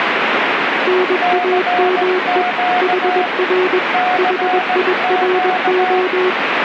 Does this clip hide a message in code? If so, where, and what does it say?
Yes: Morse code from 0.8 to 6.4 s, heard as two keyed tones, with radio static. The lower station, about 21 wpm, 370 Hz: NAME HR HIRO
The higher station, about 17 wpm, 730 Hz: CQ CQ